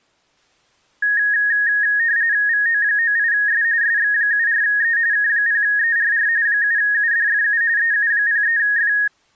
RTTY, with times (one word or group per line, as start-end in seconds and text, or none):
2.5-3.6 VO98S
3.8-5.0 SX74E
5.1-6.3 K0ERR
6.5-7.6 7UDFU
7.8-8.9 EU03F